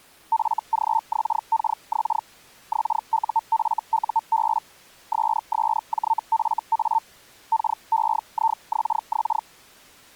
Hellschreiber (Feld-Hell, 122.5 baud), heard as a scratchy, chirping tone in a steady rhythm, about 900 Hz. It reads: FGXKX XUFUB SSJFA KEIXX